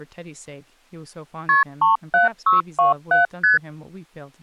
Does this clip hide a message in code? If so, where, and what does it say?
Yes: multi-frequency trunk signalling (R1, as on North American trunks) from 1.5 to 3.6 s, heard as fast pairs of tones, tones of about 140 ms, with speech in English. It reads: KP 37627 ST